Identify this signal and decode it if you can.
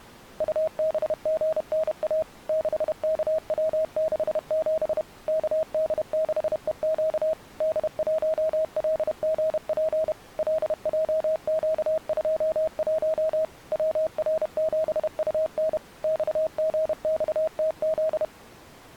Morse code, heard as a keyed tone, machine-sent, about 31 wpm, 640 Hz. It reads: UBGNA 6KW67 KD6EQ D1LGP LJQ21 WR7UN XGXTZ